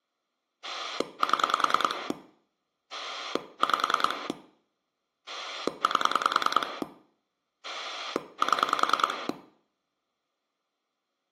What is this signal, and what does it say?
Pulse dialling, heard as a rotary dial, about 10 pulses a second, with room echo. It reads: 7 5 8 7